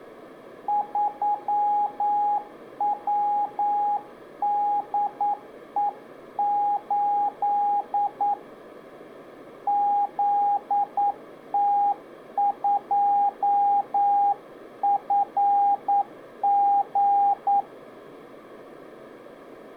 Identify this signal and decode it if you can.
Morse code, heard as a keyed tone, hand-sent with a paddle, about 9 wpm, 820 Hz. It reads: 3WDE8 ZT2FG